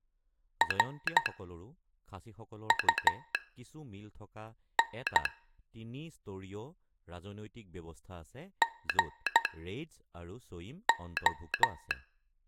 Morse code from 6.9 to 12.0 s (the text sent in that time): GO